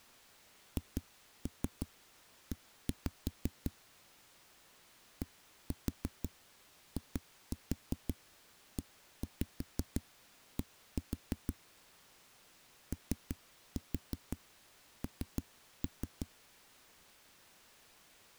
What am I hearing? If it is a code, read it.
Tap code, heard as knocks on a wall, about 6 knocks a second. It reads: HE DIED ON